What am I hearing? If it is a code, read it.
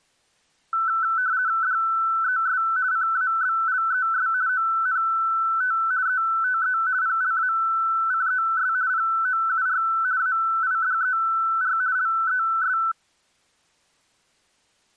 RTTY (50 baud, 170 Hz shift), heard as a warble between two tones, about 1420 Hz centre. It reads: DES CABLES ONT ETE PLACES POUR AIDER LES